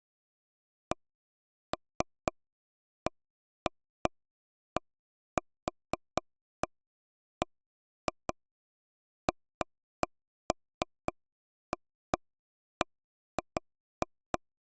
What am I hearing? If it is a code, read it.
Irregular taps on a table. There is no code.